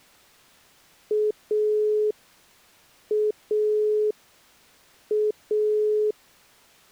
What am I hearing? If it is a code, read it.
Telephone call progress tone (pulsed, as in Italy), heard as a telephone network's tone, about 420 Hz. Dial tone.